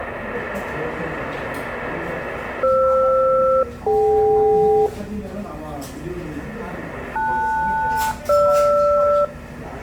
Aircraft SELCAL, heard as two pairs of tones, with the noise of a crowd indoors. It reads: FR-DK LS-GR